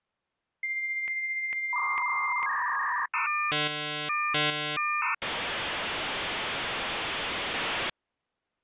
Dial-up modem handshake (V.34 or later), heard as a whistle, warbles, then hiss.